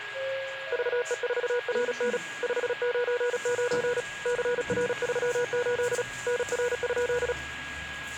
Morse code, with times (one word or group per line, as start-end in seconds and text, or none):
0.7-2.2 VE4RN
2.4-4.0 599
4.3-6.0 CR38
6.3-7.3 NR?